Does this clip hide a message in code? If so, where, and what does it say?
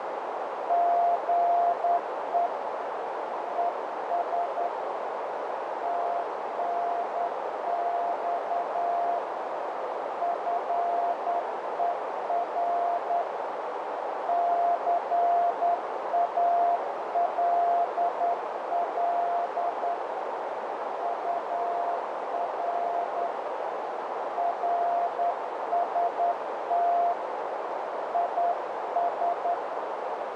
Yes: Morse code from 0.6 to 29.6 s, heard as a keyed tone, hand-sent with a straight key, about 10 wpm, 690 Hz, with heavy radio static and a narrow filter. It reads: GE ES TNX FER CALL UR RST IS